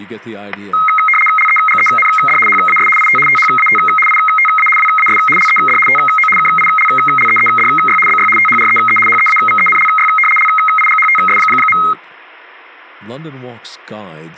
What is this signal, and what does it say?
RTTY (75 baud, 850 Hz shift), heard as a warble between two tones, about 1700 Hz centre, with static crashes and speech in English. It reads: LEGEND HAS IT THAT ITA WAS LED TO KILLEEDY BY THREE HEAVENLY LIGHTS.